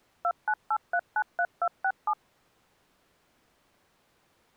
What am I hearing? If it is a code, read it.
DTMF, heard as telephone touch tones, dialled by machine, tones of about 60 ms. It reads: 298393267